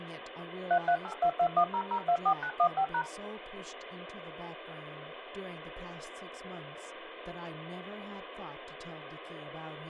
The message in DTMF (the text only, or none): 3382210024915#